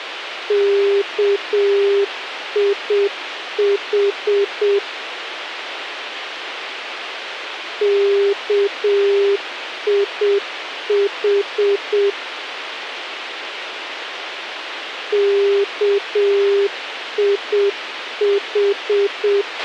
Morse code, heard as a keyed tone, machine-sent, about 7 wpm, 400 Hz, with radio hiss and a squelch burst at the end. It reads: KIH KIH KIH